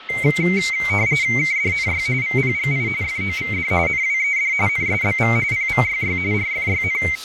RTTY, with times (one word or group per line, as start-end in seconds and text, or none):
1.4-2.1 KDNY
2.2-2.9 VPGI
3.0-3.7 FOVD
3.9-4.5 NWED
4.7-5.4 NSBV
5.5-6.2 PVYY
6.3-7.0 RFYN